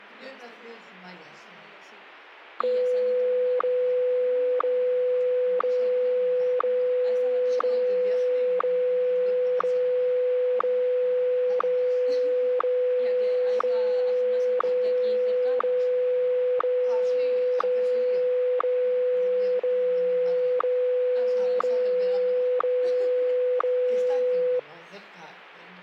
Radio time signal (WWVH, Hawaii), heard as ticks, one a second.